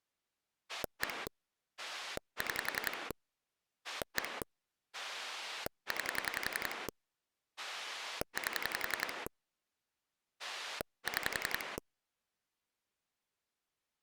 Pulse dialling, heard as a rotary dial, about 11 pulses a second. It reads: 1 6 1 9 8 6